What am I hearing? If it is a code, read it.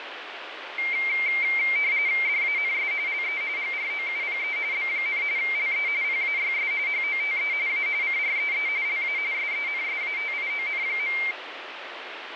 RTTY (45.45 baud, 170 Hz shift), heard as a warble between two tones, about 2200 Hz centre, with radio static. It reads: DANS LE GROUPE B, LE PAYS HOTE A CREE LA SENSATION.